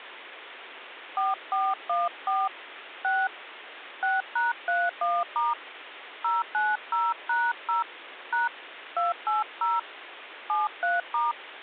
DTMF, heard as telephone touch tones, dialled by hand, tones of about 180 ms, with phone line noise. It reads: 4414 6 6#31* 090#0 # 280 73*